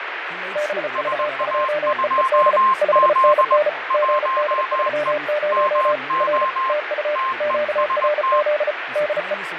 Morse code, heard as two keyed tones, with radio static, fading and speech in English. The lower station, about 34 wpm, 600 Hz: BV2EED 5NN GD30 R TU QRZ DE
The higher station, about 20 wpm, 1060 Hz: SA2Z 1E MO TEST